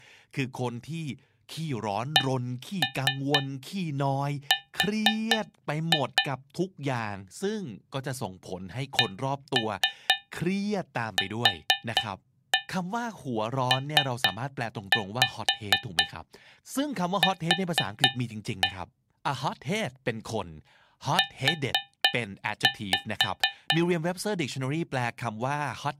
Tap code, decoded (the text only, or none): CR CQPQ U